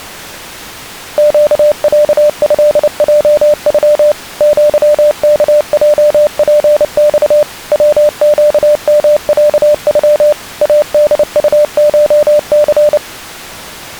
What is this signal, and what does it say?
Morse code (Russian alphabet), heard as a keyed tone, machine-sent, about 29 wpm, 600 Hz. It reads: ЩЯЭЙЮ ЪКЙПЬ ВЩМЯЮ АДУШЦ